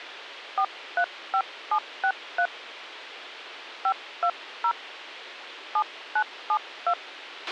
DTMF, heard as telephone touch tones, dialled by hand, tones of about 70 ms, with radio hiss and a squelch burst at the end. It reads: 435763 520 7972